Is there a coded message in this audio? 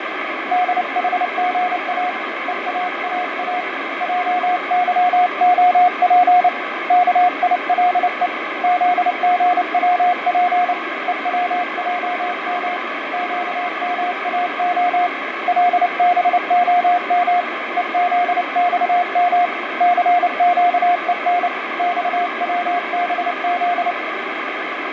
Yes: Morse code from 0.5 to 24.0 s, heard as a keyed tone, hand-sent with a paddle, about 29 wpm, 720 Hz, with heavy radio static and fading. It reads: DHGA EAAA JYOP KILE ZGWP EWJM QMAO LBOM EZXM CQEN XWBZ